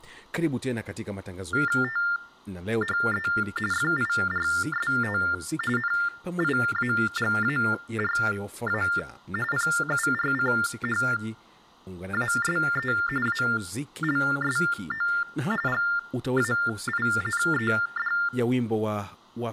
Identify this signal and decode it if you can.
TTY/TDD text telephone tones (45.45 baud Baudot), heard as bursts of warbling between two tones, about 400 Hz shift, 1600 Hz centre, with speech in Swahili. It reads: THE FIRST NIAGARA PURCHASE ALSO GAINED